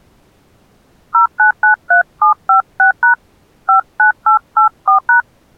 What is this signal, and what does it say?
DTMF, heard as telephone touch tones, dialled by hand, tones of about 110 ms. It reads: 0993756# 59884#